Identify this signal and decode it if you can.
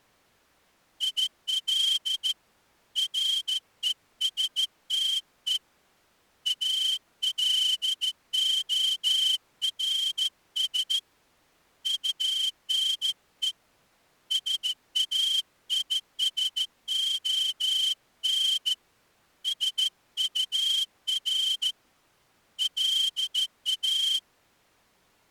Morse code, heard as a whistle, hand-sent with a straight key, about 14 wpm. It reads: IL RESTE ALORS UNE SAISON SUR LA